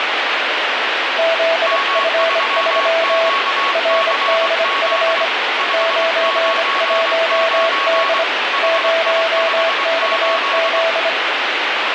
Morse code, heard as two keyed tones, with heavy radio static. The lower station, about 25 wpm, 660 Hz: ZF3 RDF 91D 0XZ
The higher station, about 23 wpm, 1110 Hz: M3QCZ 599 HI58